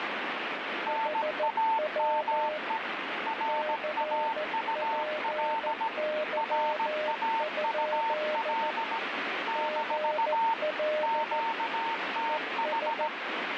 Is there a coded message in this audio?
Yes: Morse code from 0.8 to 13.1 s, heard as two keyed tones, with radio static. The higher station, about 17 wpm, 900 Hz: NAME RAUL RAUL - QTH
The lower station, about 14 wpm, 610 Hz: HW CPY? GL ES